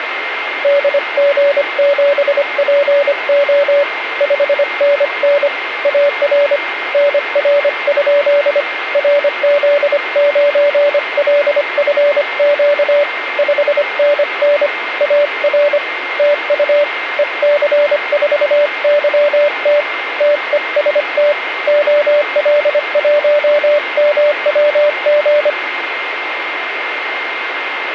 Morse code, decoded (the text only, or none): DG7PO 5NN AR NR? RZ9LFQ 5NN AR TU EC4YT TEST OL1MWG